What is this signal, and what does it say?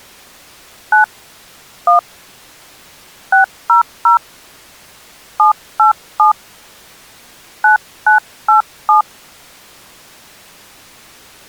DTMF, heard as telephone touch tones, dialled by hand, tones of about 120 ms. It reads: 9 1 600 787 9987